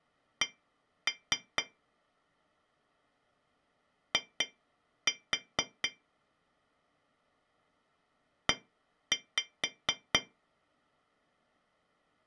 Tap code, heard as taps on glass, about 4 knocks a second. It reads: C I E